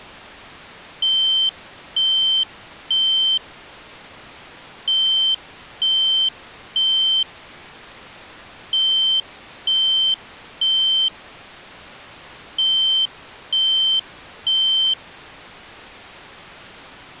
Alarm pattern, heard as an alarm's beeps, played four times, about 3100 Hz. Temporal three. Smoke or fire, evacuate.